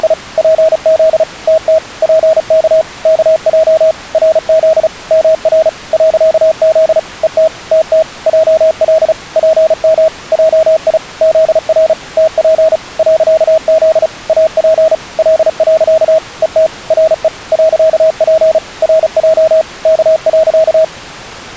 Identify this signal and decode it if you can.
Morse code, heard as a keyed tone, machine-sent, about 35 wpm, 640 Hz. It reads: … PZ TT PK KJ RZ MR .Z ET TT JL PM JI ZR TP .Z AP L. ET RE .P RJ K.